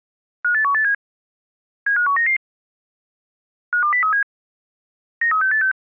Five-tone selective call (CCIR), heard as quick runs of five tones, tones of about 100 ms. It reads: 58187 75199 52037 93686